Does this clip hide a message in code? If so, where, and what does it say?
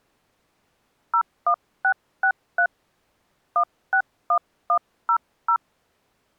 Yes: DTMF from 1.1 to 5.6 s, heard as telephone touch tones, dialled by hand, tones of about 80 ms. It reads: 01663 161100